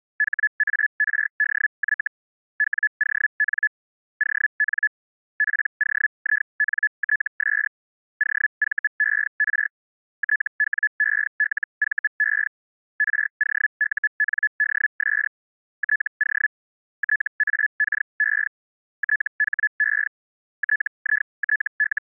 Hellschreiber (Feld-Hell, 122.5 baud), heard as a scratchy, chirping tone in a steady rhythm, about 1700 Hz. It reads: HARDY WON ON POINTS OVER TWELVE ROUNDS TO TAKE THE …